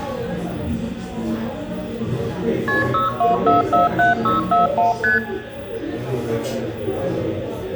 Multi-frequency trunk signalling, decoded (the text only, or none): KP 62447641 ST